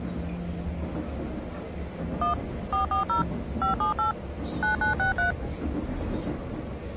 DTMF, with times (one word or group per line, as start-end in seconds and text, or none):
2.2-2.3 1
2.7-3.2 440
3.6-4.1 578
4.6-5.3 9963